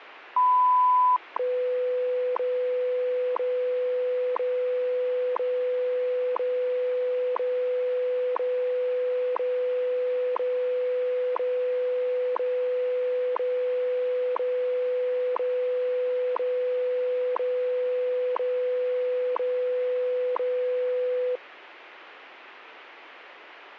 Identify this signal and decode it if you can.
Radio time signal (WWV, Colorado), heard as ticks, one a second, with radio static.